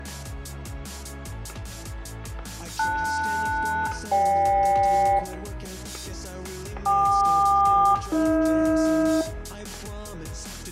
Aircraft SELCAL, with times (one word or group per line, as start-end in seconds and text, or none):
2.8-5.2 LS-GK
6.9-9.2 KQ-AH